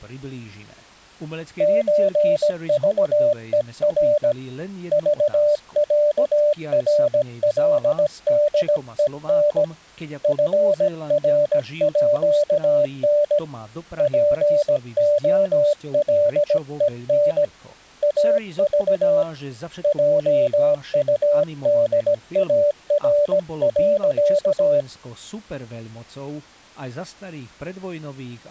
Morse code (with Swedish letters), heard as a keyed tone, hand-sent with a paddle, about 17 wpm, 590 Hz. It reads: ÖVER VÄRLDEN FRÅN POLEN AV JUDAR.